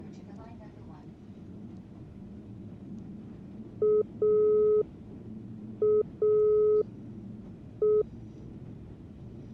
Telephone call progress tone (pulsed, as in Italy), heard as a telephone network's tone, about 420 Hz, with the noise inside a subway train. Dial tone.